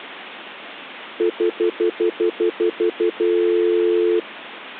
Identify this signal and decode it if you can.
Telephone call progress tone (North American plan), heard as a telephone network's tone, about 350, 440 Hz, 0.1 s on and 0.1 s off. Stutter dial tone.